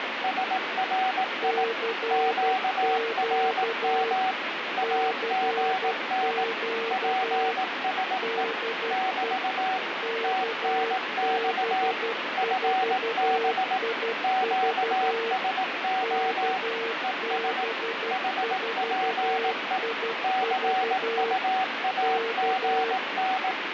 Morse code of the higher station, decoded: SRI QRM AGN PSE <BT> TNX FB QSO ES HPE CUAGN

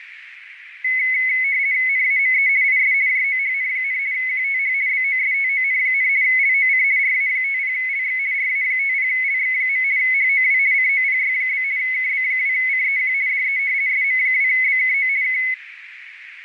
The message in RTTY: NAME IS JOHN, QTH BOSTON, LOC RA50LX RA50LX. HOW COPY? KB2CEQ DE SM2BKO K

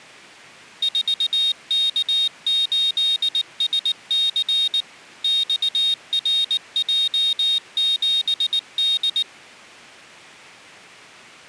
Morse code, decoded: 4K8SC XRJ7D

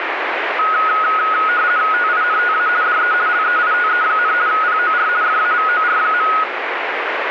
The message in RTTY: TINTA DE LEITE, POR FAVOR.

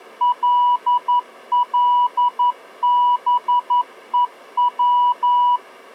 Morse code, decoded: LLBEW

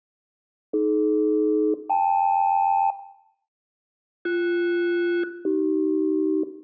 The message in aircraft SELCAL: AD-KL BS-AC

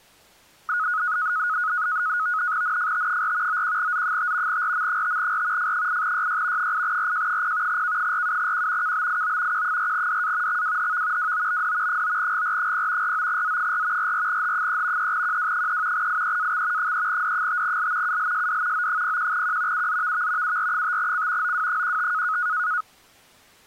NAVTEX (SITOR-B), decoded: NFT4 91Z5 RM5R F8YY 8RJ0 K47Q KBIO Q4DA XWHV WOBD 9GR0 49Z4 44H3 3QW3 IEAX 3D5L ULSD O01Q UZVV UR5C OW15

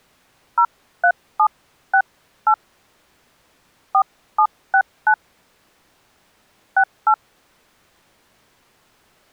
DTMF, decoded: 03768 4769 68

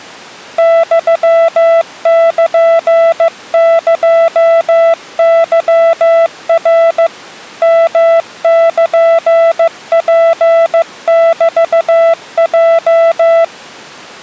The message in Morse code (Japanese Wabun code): ユルエケナ ヨルツメヲ

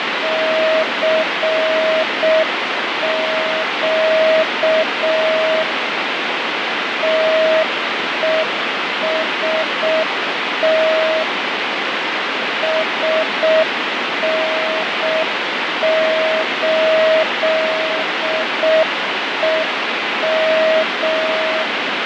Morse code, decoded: CQ TEST SN8EM

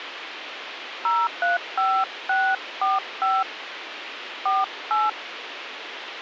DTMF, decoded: 035645 48

